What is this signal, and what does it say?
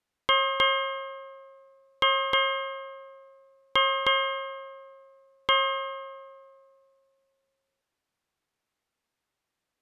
Ship's bell, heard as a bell. 7. Seven half-hours of the watch have passed.